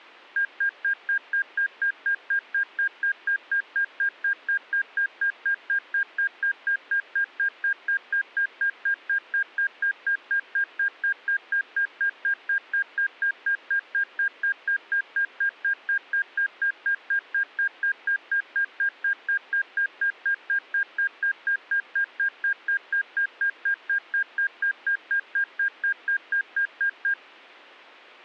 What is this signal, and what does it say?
Evenly repeated beeps. There is no code.